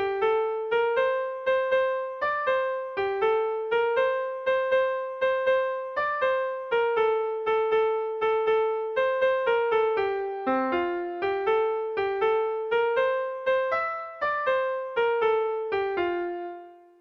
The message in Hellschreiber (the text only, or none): none